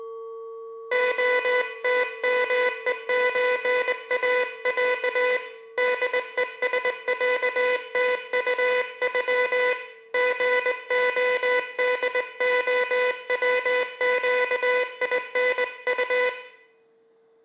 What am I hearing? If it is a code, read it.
Morse code (Russian alphabet), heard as a buzzer, hand-sent with a straight key, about 20 wpm, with room echo. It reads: ОТМЕЧАЯ ДЕСЯТУЮ ГОДОВЩИНУ